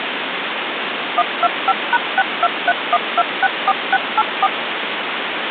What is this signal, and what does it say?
DTMF, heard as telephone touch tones, dialled by machine, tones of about 40 ms, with phone line noise. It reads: 125#6231264684